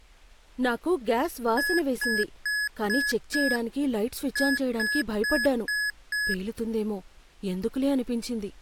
Beep code, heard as beeps from a small speaker, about 1700 Hz, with speech in Telugu. 5-5.